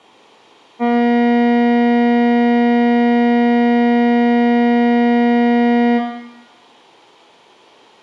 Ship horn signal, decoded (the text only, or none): 1 long